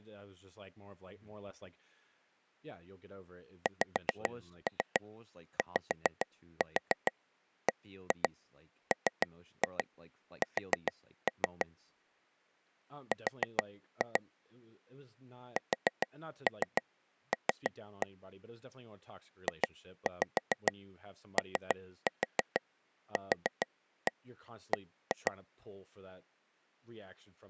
Tap code, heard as taps on a table, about 6 knocks a second, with speech in English. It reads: XYBMS R SL JOQB